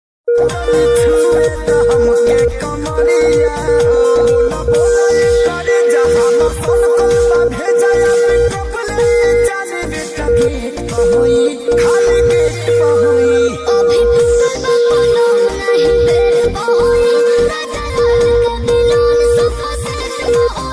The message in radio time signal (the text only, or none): 0 0 1 0 0 0 0 0 1 M 1 0 0 0 0 0 0 1 0 M